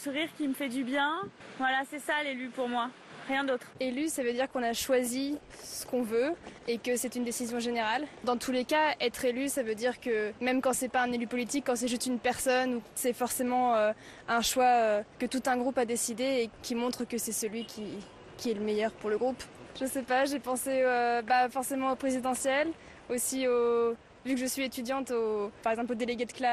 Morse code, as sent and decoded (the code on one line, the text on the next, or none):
none